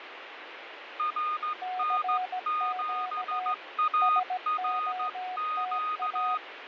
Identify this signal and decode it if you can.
Morse code, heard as two keyed tones, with radio static and fading. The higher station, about 14 wpm, 1240 Hz: RN7ARQ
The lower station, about 17 wpm, 740 Hz: CQ SOTA